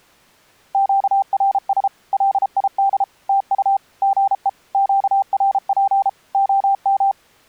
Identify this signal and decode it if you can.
Morse code, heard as a keyed tone, machine-sent, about 33 wpm, 790 Hz. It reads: QRS LID TU GE QRP OM